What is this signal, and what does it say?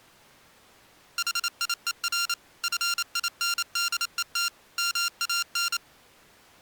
Morse code, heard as electronic beeps, machine-sent, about 28 wpm, 1390 Hz. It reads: HIER FINDET MAN